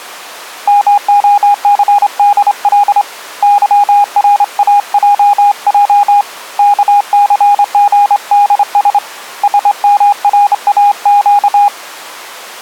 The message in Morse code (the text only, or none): MOCDL YRAJJ KCGDS SMRAQ